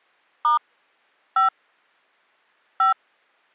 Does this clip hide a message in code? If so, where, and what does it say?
Yes: DTMF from 0.4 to 2.9 s, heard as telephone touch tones, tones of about 130 ms. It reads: * 5 5